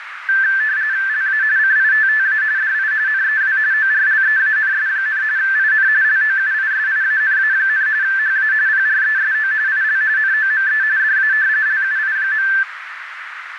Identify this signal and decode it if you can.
RTTY (45.45 baud, 170 Hz shift), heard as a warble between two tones, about 1650 Hz centre, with radio static and a narrow filter. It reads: LA CITTA DI NEW ORLEANS, IN LOUISIANA, HA PRESO IL NOME DA LUI.